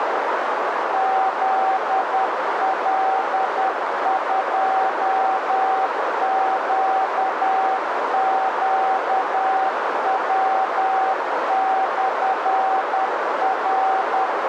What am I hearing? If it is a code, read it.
Morse code, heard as a keyed tone, machine-sent, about 10 wpm, 770 Hz, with heavy radio static and a narrow filter. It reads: ZL2QQW/R